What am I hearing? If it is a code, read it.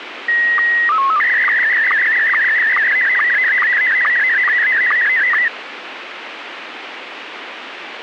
SSTV (slow-scan television), Scottie S1, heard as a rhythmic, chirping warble, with radio hiss.